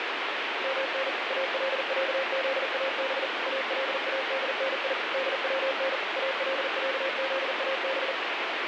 Morse code (Arabic alphabet), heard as a keyed tone, machine-sent, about 40 wpm, 540 Hz, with heavy radio static. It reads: من العذاب الادني دون العذاب